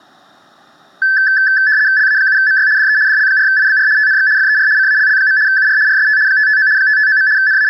RTTY (75 baud, 170 Hz shift), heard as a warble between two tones, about 1650 Hz centre, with room echo. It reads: LA7MY DE DL4IBR TNX FER CALL. UR RST 559 559. …